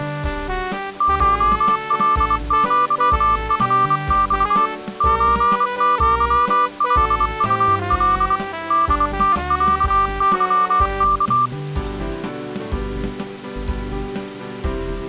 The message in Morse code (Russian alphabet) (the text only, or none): ШЛЪФЬ ЧЪЛУЛ ДТЯЫК